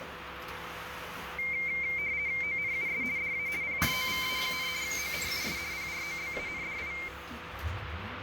RTTY (50 baud, 170 Hz shift), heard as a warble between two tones, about 2200 Hz centre, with radio static and the noise inside a bus. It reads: ONUS DA PROVA, ONUS PROBANDI